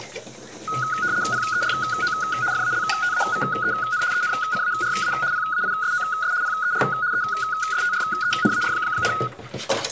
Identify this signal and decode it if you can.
RTTY (75 baud, 170 Hz shift), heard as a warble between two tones, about 1360 Hz centre, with kitchen noise. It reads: PERO FALTAVEN ENCARA PAISOS PER ESTRENAR,